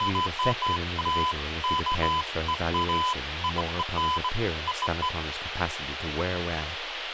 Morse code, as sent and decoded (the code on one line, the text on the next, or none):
none